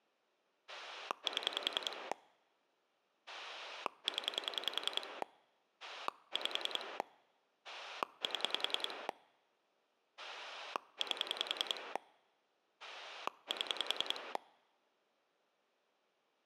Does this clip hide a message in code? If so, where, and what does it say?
Yes: pulse dialling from 0.7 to 14.4 s, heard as a rotary dial, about 10 pulses a second. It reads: 7 0 5 7 8 7